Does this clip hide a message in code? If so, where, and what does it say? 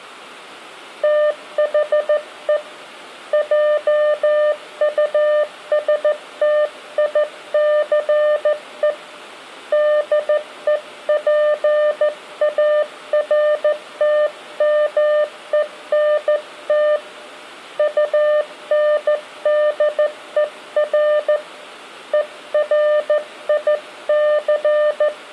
Yes: Morse code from 1.0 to 25.1 s, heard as a keyed tone, hand-sent with a straight key, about 14 wpm, 600 Hz, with room echo. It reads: THE JUSTICE DEPARTMENT UNDER ERIC